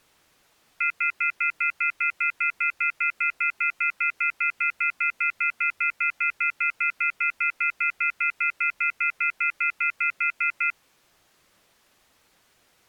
Telephone call progress tone (North American plan), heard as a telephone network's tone, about 1400, 2050, 2450, 2600 Hz, 0.1 s on and 0.1 s off. Off-hook warning tone.